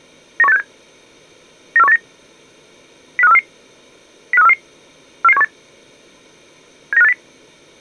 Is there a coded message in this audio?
Yes: five-tone selective call (EEA) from 0.4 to 7.1 s, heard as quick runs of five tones, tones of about 40 ms. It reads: 91867 94189 05344 05344 44718 79580